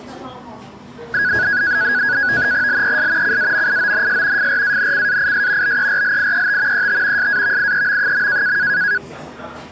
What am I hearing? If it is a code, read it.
NAVTEX (SITOR-B), 100 baud, 170 Hz shift, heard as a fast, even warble, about 1550 Hz centre, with the noise of a cafe. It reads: LES CAMIONS FRANCAIS BERLIET ET SAVIEM.